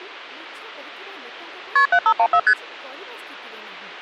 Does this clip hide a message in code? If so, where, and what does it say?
Yes: multi-frequency trunk signalling (R1, as on North American trunks) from 1.8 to 2.5 s, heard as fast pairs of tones, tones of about 70 ms, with speech in Odia. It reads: KP 7514 ST